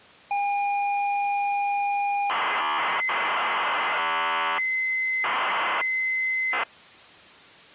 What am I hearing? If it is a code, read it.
ZX Spectrum tape loading, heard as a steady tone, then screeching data.